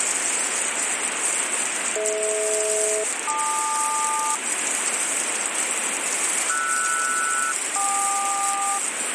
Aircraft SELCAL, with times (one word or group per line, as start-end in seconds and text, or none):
2.0-4.4 DH-LQ
6.5-8.8 RS-KQ